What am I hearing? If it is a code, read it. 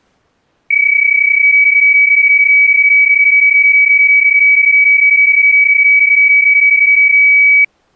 PSK31 (31.25 baud), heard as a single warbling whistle, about 2300 Hz.